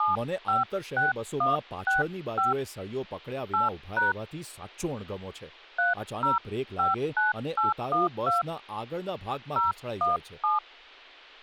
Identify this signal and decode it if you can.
DTMF, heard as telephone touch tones, dialled by hand, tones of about 150 ms, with speech in Gujarati. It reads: 756165 8# 3059812 017